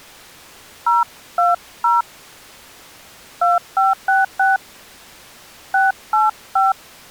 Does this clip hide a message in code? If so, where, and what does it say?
Yes: DTMF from 0.9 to 6.7 s, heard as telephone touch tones, dialled by hand, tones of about 170 ms. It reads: 020 2566 685